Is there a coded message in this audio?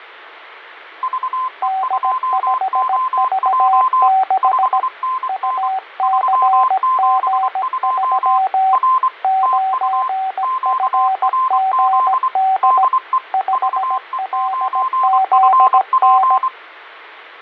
Yes: Morse code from 1.0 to 16.5 s, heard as two keyed tones, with fading. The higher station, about 24 wpm, 1040 Hz: VE2OJ 5NN 372 R TU QRZ DE VE9FP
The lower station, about 17 wpm, 760 Hz: D5V6 UCG3 9FGD 5LZN